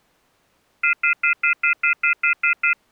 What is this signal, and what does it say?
Telephone call progress tone (North American plan), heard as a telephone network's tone, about 1400, 2050, 2450, 2600 Hz, 0.1 s on and 0.1 s off. Off-hook warning tone.